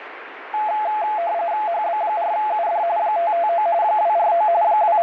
RTTY (45.45 baud, 170 Hz shift), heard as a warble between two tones, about 770 Hz centre, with radio static. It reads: HB4UD 559 249 …